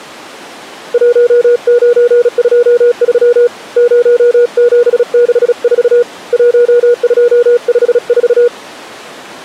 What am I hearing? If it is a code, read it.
Morse code, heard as a keyed tone, hand-sent with a paddle, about 36 wpm, 480 Hz. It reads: 1923 0764 1254